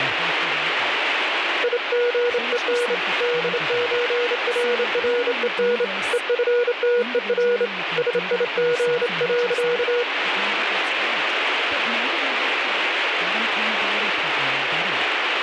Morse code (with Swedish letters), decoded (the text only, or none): IGEN DÖRREN EFTER SIG.